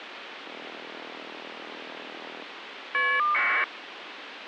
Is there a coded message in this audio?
Yes: caller ID data burst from 0.4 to 3.6 s, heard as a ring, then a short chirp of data, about 1200 baud, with phone line noise.